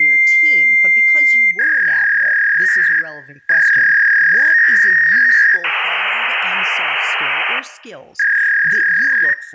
Fax machine handshake, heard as a long tone, a warble and hiss, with room echo and speech in English.